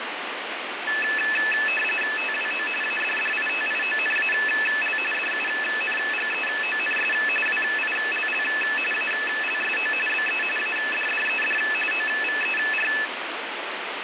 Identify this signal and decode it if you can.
RTTY (45.45 baud, 850 Hz shift), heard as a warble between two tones, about 2150 Hz centre, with radio static. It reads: TWO ADDITIONAL DUNGEONS WILL ALSO BE ADDED OVER